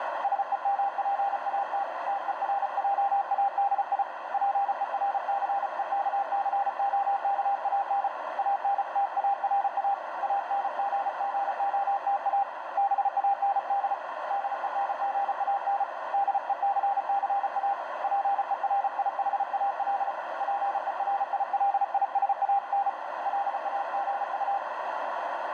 Morse code, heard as a keyed tone, hand-sent with a paddle, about 34 wpm, 800 Hz, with heavy radio static and a narrow filter. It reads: SEMPAT TERJADI PERCEKCOKAN ANTARA ANGGOTA BAND DENGAN DECCA PERIHAL PERILISAN LAGU